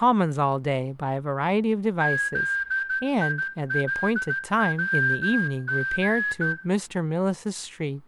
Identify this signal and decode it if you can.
Morse code, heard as a whistle, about 14 wpm, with room echo and speech in English. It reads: ZILWG